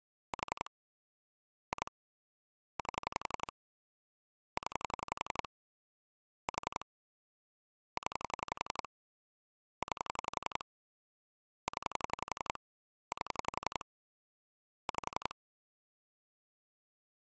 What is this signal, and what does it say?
Pulse dialling, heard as clicks on a phone line, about 11 pulses a second. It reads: 4 2 8 0 4 0 9 0 8 5